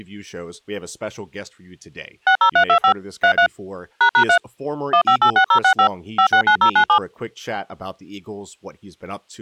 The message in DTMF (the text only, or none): 60325 33 ##3 1586065 569097